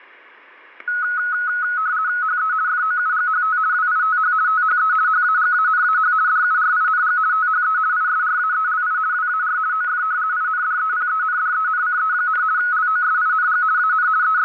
RTTY (50 baud, 170 Hz shift), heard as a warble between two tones, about 1370 Hz centre, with static crashes. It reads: HE FOUGHT WITH THE HAGANAH DURING THE ISRAELI WAR OF INDEPENDENCE, LOSING AN …